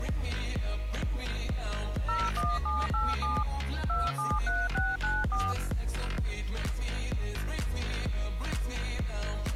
DTMF, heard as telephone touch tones, dialled by machine, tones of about 210 ms. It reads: 01787 273694